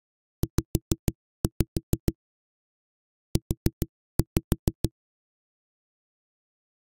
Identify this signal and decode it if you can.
Tap code, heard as knocks on a wall, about 6 knocks a second. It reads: Z U